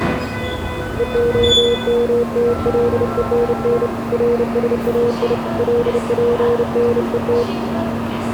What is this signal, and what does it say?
Morse code (Hebrew alphabet), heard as a keyed tone, hand-sent with a bug key, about 30 wpm, 480 Hz, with the noise of a subway station. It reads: והמתלונן רשאי לפנות